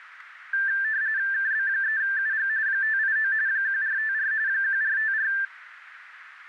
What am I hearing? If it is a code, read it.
RTTY (45.45 baud, 170 Hz shift), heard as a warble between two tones, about 1650 Hz centre, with radio static. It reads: KB3UG 589 1454 1454